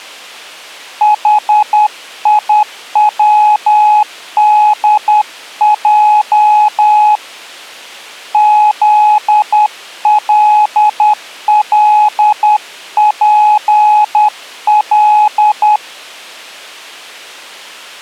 Morse code, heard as a keyed tone, hand-sent with a paddle, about 10 wpm, 840 Hz. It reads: HIWDJ ZLLPL